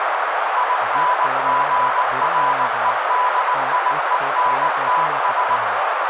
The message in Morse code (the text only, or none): INGREDIENTS